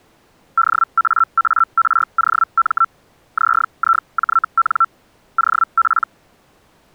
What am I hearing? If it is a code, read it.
Hellschreiber (Feld-Hell, 122.5 baud), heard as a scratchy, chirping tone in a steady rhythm, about 1340 Hz. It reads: DAAROM ZIJN OP